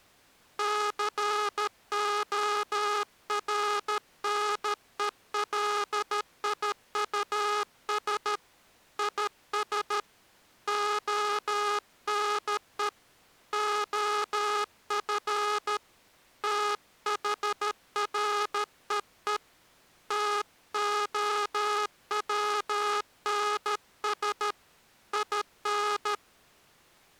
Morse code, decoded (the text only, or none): CORNELIUS IS ONE OF THREE TOWNS IN